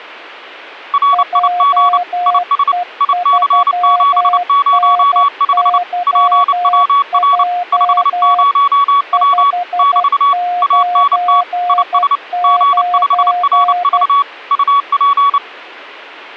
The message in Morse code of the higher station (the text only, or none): RIG IS IC705 PWR 50W <BT> ANT IS G5RV UP